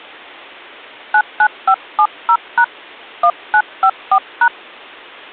DTMF, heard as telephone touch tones, dialled by hand, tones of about 70 ms. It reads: 99570# 1954#